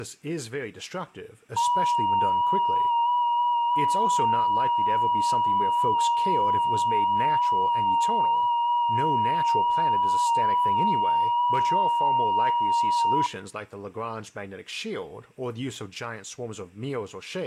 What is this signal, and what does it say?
FT8 (one signal), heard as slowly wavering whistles, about 6.25 baud, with speech in English.